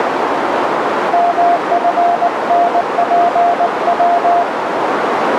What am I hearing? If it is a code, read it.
Morse code, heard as a keyed tone, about 19 wpm, 700 Hz, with radio static and a narrow filter. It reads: MFNPW